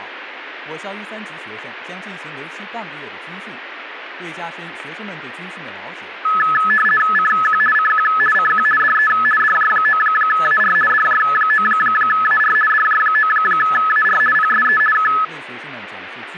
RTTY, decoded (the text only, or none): CQ CQ CQ DE DJ9AR DJ9AR DJ9AR PSE K